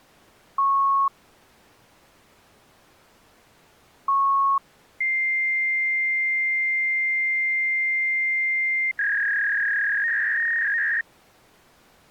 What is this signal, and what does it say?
Fax machine handshake, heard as beeps, a long tone and a warble.